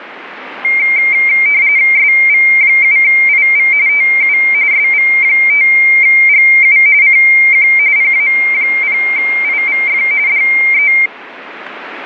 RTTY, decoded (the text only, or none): SV7IV TU SV5GU CQ PA0IVF DE